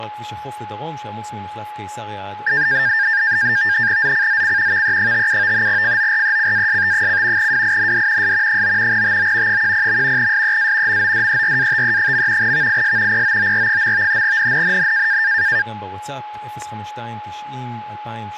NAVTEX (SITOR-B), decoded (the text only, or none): ZCZC VE57 FORECAST: WIND S 9 TO 10. SEA MODERATE. VIS POOR. NNNN